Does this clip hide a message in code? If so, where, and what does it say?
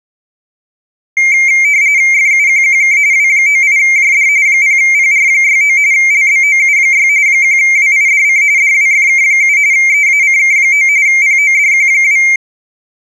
Yes: RTTY (45.45 baud, 170 Hz shift) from 1.2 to 12.4 s, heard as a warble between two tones, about 2200 Hz centre. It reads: FUQQK W98JD 0PR69 LBOU6 1WIDC DWFK7 EACK9 PODQ2